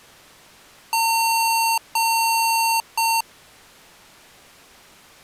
Beep code, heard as beeps from a small speaker, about 910 Hz. 2 long, 1 short.